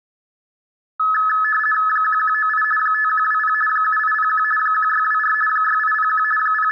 RTTY (50 baud, 450 Hz shift), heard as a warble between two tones, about 1500 Hz centre, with room echo. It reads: 1198 5120 7801 1624 6801 …